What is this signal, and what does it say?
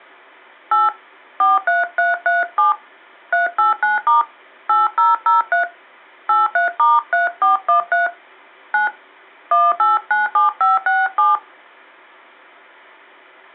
DTMF, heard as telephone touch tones, dialled by hand, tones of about 170 ms. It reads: 8 43337 389* 8003 83*3413 9 1897567